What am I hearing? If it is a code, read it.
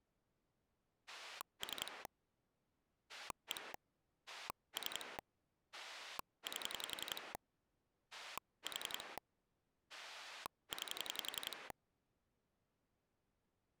Pulse dialling, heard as a rotary dial, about 11 pulses a second. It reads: 3 1 3 8 4 9